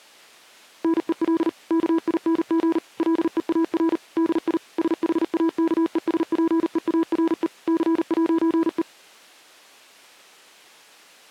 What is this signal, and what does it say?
Morse code, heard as a keyed tone, machine-sent, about 39 wpm, 330 Hz. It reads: NEL KING LEAR DI SHAKESPEARE C'E